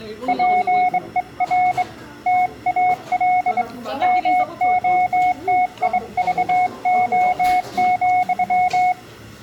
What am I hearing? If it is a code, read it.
Morse code, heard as a keyed tone, hand-sent with a straight key, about 23 wpm, 730 Hz, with room echo and the noise of a restaurant. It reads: PER TAL MOTIVO,